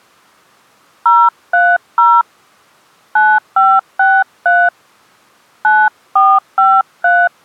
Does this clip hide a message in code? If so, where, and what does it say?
Yes: DTMF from 1.1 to 7.3 s, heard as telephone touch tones, dialled by hand, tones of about 230 ms. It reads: 030 9563 9453